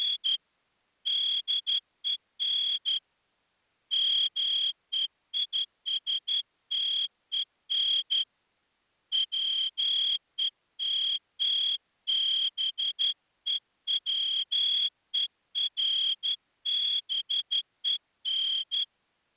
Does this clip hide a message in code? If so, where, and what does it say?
Yes: Morse code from 0.0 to 18.9 s, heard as a whistle, hand-sent with a straight key, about 12 wpm. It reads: … DEN MEISTEN WETTBEWERBEN